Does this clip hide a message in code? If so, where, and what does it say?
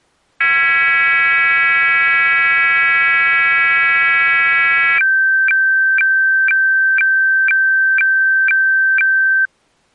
Yes: weather fax (radiofax), 120 lines a minute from 0.4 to 9.5 s, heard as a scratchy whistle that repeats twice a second.